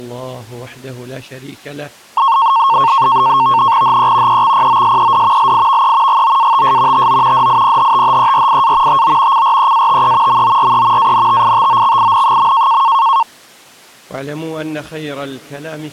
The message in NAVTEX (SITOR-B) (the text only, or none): HE EXPOSED LIVE GOATS TO DIPHTHERIA TO CREATE MORE ANTITOXIN.